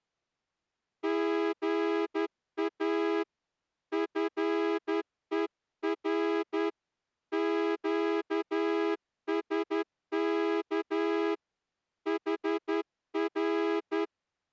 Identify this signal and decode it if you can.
Morse code, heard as a horn, hand-sent with a straight key, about 11 wpm. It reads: GA FER QSK HR